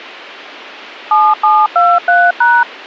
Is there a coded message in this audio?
Yes: DTMF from 1.1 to 2.6 s, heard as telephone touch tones, dialled by machine, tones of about 230 ms. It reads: 7723#